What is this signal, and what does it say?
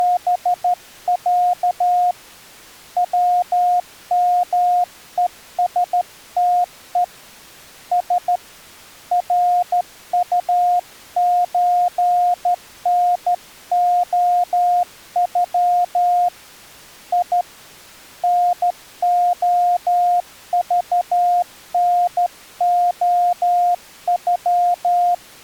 Morse code (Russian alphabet), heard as a keyed tone, hand-sent with a straight key, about 13 wpm, 710 Hz. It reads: … ВМЕСТЕ С РУЧНОЮ И НОЖНОЮ